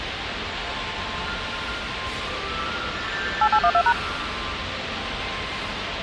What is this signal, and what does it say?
DTMF, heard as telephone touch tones, dialled by machine, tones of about 70 ms, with radio hiss, a squelch burst at the end and the noise of a subway station. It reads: 8812#